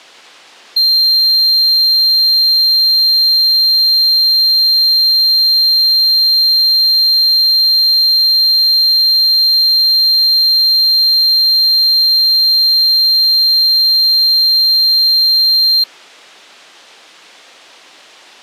A steady tone. There is no code.